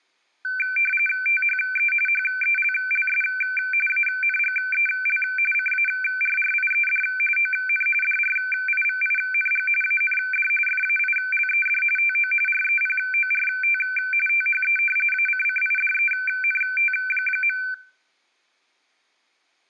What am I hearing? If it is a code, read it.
RTTY (45.45 baud, 850 Hz shift), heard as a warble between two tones, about 1950 Hz centre, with room echo. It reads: THE HELLS ANGEL CARRIED ON DRIVING AND FAILED TO REPORT THE ACCIDENT.